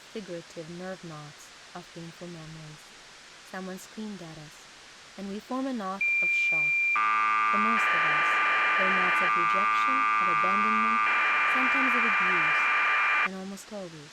Cassette data (Kansas City type), 1200 baud, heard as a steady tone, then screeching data, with speech in English.